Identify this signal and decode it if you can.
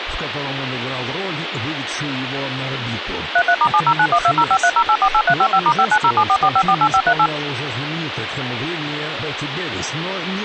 DTMF, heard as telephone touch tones, dialled by machine, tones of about 70 ms, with phone line noise. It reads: 33*709120530848355*590744548538